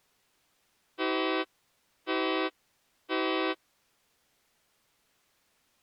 Train horn signal, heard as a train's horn. 3 short. On North American railways: when stopped, the train will back up.